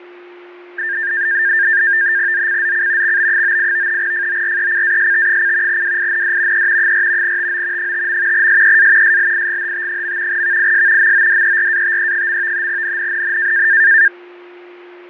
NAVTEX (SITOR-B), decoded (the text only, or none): ZCZC XB98 FORECAST: WIND E 4 TO 5. SEA SLIGHT. VIS MODERATE. NNNN